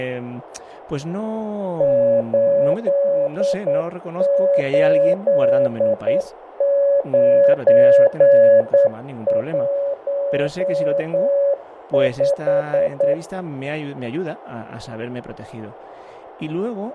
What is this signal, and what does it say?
Morse code, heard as a keyed tone, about 9 wpm, 560 Hz, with radio static, fading and speech in Spanish. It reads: 88915